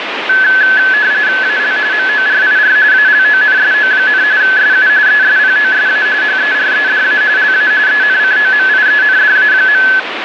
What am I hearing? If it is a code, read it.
RTTY (45.45 baud, 170 Hz shift), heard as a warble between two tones, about 1600 Hz centre, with radio static. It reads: AL MORIR ALONSO, SU ESPOSA HEREDA LA ENCOMIENDA.